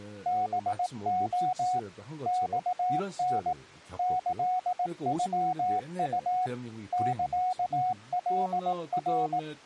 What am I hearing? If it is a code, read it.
Morse code (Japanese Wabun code), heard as a keyed tone, machine-sent, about 18 wpm, 740 Hz, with speech in Korean. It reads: ハレ マタ キノウ サカナ